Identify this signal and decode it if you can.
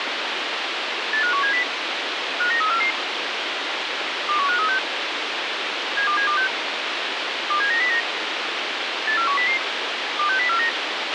Five-tone selective call (CCIR), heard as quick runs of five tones, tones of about 100 ms, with radio hiss and a squelch burst at the end. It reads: 85170 59344 21536 72726 27909 84100 26049